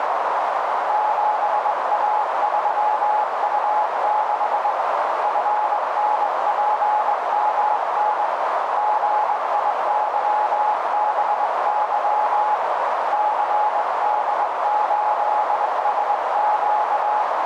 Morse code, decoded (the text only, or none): 7A3U6 FNPMN GIYBY CD8SQ